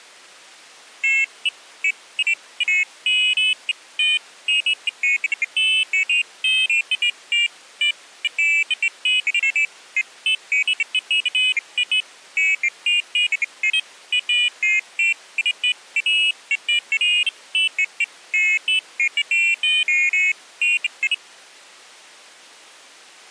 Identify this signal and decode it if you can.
Pairs of high tones at irregular times. There is no code.